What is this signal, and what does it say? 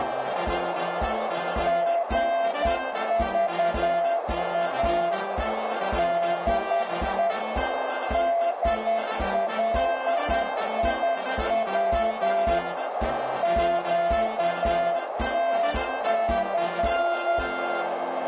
Morse code, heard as a keyed tone, machine-sent, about 10 wpm, 680 Hz, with heavy radio static and a narrow filter. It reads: GVA DE DLIW QTC